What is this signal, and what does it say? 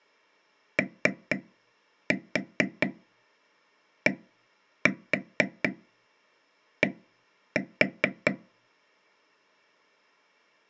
Tap code, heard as taps on a table, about 4 knocks a second. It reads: ODD